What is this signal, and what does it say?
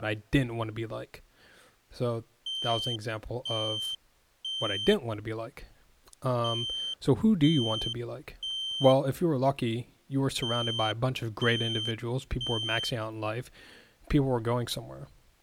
Alarm pattern, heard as an alarm's beeps, played three times, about 3100 Hz, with speech in English. Temporal three. Smoke or fire, evacuate.